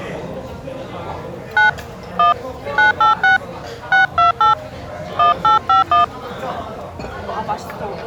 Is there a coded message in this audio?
Yes: DTMF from 1.6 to 6.0 s, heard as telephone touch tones, dialled by hand, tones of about 130 ms, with the noise of a restaurant. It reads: 9 1 986 628 1851